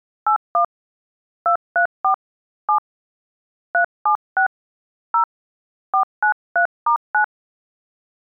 DTMF, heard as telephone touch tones, dialled by hand, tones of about 100 ms. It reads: 81 234 7 376 0 493*9